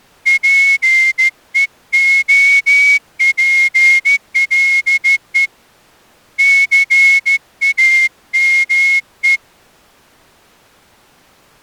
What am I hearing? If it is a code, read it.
Morse code, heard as a whistle, hand-sent with a straight key, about 14 wpm. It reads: PEOPLE CAME